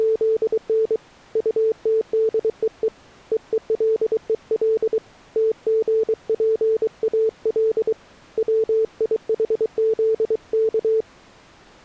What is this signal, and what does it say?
Morse code (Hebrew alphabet), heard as a keyed tone, hand-sent with a paddle, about 23 wpm, 440 Hz. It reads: … טתדוו וולול תגפאל ציחזך